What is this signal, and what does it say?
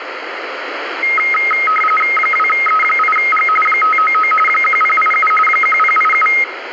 RTTY (45.45 baud, 850 Hz shift), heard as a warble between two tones, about 1700 Hz centre, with radio static. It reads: 2E8G 599 1087 1087